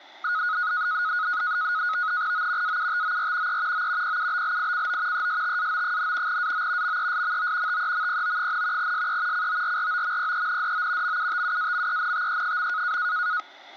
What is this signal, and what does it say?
NAVTEX (SITOR-B), 100 baud, 170 Hz shift, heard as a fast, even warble, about 1360 Hz centre, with static crashes. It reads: O AUTOR E O PUBLICO ESTAO, AO MESMO TEMPO, SE CORROMPENDO MUTUAMENTE.